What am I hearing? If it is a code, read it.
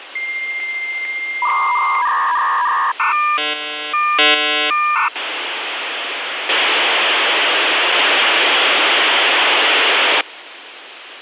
Dial-up modem handshake (V.34 or later), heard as a whistle, warbles, then hiss, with phone line noise.